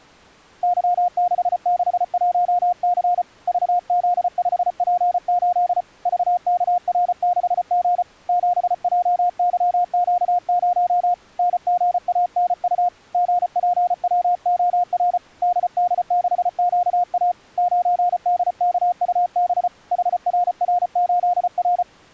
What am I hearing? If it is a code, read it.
Morse code, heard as a keyed tone, hand-sent with a paddle, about 34 wpm, 710 Hz. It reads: Y661C VZ5P8 VKR6G 7JYQ0 NGANU GPWOR DD6QA 9DKUB HRR8R